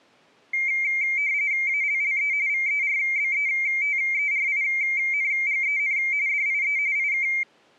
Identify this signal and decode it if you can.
RTTY (45.45 baud, 170 Hz shift), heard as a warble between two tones, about 2200 Hz centre. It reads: ALLE VERBETERINGEN DIE IK